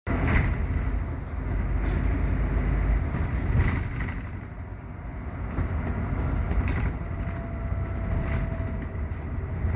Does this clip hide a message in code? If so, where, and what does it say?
No, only the noise inside a bus.